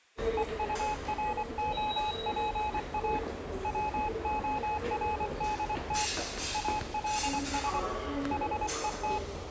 Morse code, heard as a keyed tone, hand-sent with a paddle, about 24 wpm, 850 Hz, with the noise of a subway station. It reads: EUROPA WORDT ALS HET